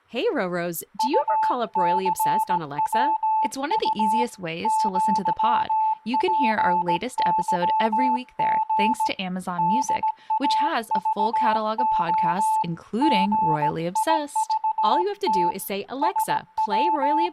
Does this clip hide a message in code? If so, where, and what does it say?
Yes: Morse code (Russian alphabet) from 0.9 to 17.3 s, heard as a keyed tone, hand-sent with a paddle, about 17 wpm, 870 Hz, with room echo and speech in English. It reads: УЦВУ ЪПЫГ ДАЖО ГИЖТ …